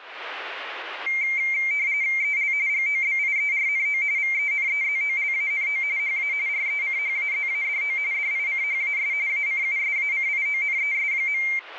RTTY (45.45 baud, 170 Hz shift), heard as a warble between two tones, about 2200 Hz centre, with radio static. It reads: EL GOBIERNO VENEZOLANO HA RECHAZADO DICHAS ACUSACIONES.